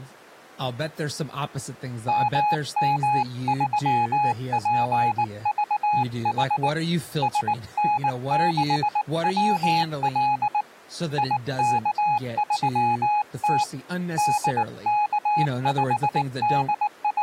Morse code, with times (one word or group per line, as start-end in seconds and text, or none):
2.1-6.7 MM3PVH
7.2-10.6 SN6WL
11.2-13.6 IK3T
14.2-17.2 …